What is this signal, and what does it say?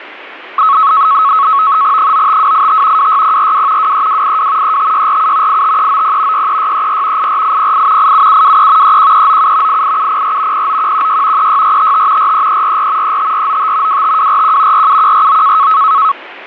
NAVTEX (SITOR-B), 100 baud, 170 Hz shift, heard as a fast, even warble, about 1200 Hz centre, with radio static and static crashes. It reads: 95285 26042 23282 35647 85390 63634 84808 87723 31397 88704 09116 36455 43344 35495 25241 47149